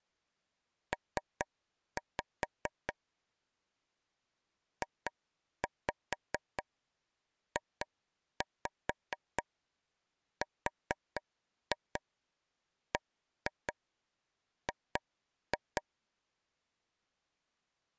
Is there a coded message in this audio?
Yes: tap code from 0.9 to 15.8 s, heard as taps on a table, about 4 knocks a second. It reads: P JJRBG